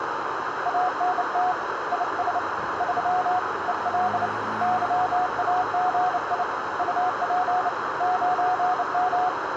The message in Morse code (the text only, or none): ANT IS 3 EL YAGI UP 9M